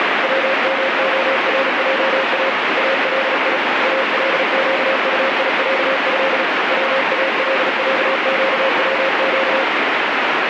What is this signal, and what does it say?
Morse code (Arabic alphabet), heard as a keyed tone, hand-sent with a paddle, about 37 wpm, 540 Hz, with heavy radio static. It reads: ومخرجا الي القطيعه والعقوق